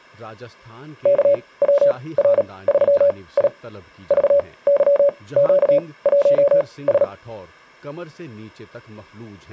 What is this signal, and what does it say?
Morse code, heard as a keyed tone, machine-sent, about 37 wpm, spaced as for 22 wpm, 570 Hz, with speech in Urdu. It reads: KWR3I VYQ1S